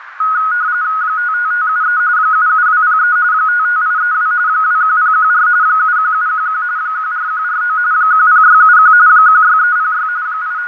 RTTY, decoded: 55573 77203 55832 21014 71711 14149 10671 16306 …

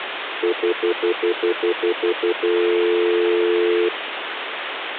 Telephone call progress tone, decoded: stutter dial tone

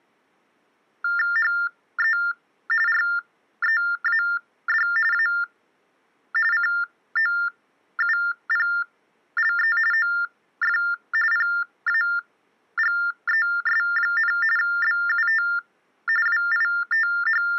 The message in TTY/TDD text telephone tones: HE READ A COUPLE OF PAGES, BUT …

